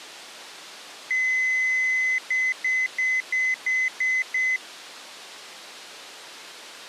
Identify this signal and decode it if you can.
Beep code, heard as beeps, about 2050 Hz. 1 long, 7 short.